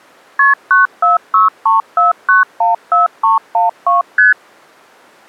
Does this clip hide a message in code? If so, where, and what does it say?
Yes: multi-frequency trunk signalling (R1, as on North American trunks) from 0.4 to 4.3 s, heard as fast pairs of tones, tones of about 150 ms. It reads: KP 94634914312 ST